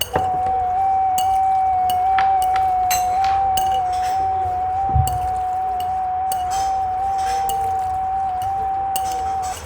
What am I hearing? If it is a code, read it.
FT8 (one signal), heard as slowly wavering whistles, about 6.25 baud, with radio static, a narrow filter and the noise of a restaurant.